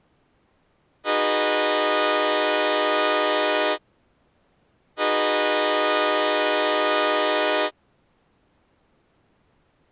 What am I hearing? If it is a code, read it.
Train horn signal, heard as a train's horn. 2 long. On North American railways: brakes released, proceed.